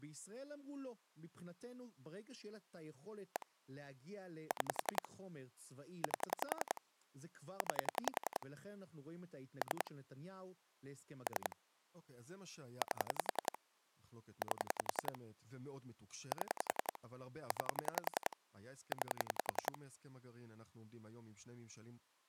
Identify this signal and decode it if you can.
Pulse dialling, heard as clicks on a phone line, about 10 pulses a second, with speech in Hebrew. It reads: 1 6 8 9 3 3 8 8 7 9 9